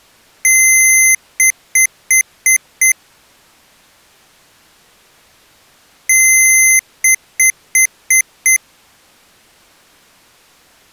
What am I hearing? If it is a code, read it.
Beep code, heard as beeps from a small speaker, played twice, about 2050 Hz. 1 long, 5 short.